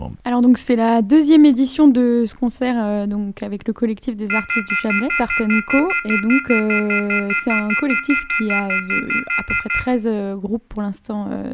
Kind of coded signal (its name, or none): telephone call progress tone